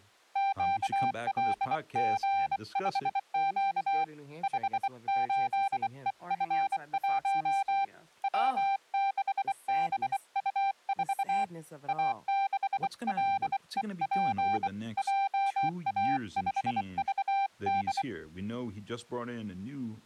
Morse code, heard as a keyed tone, hand-sent with a bug key, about 24 wpm, 790 Hz, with speech in English. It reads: QLG5Q 58EF1 W6BU4 A6LEP JA5VD